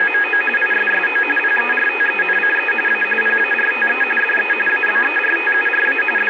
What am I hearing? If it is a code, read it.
RTTY (45.45 baud, 850 Hz shift), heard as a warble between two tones, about 2100 Hz centre, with radio static. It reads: … ISSO PERTENCE A PARTE DE ABERTURA …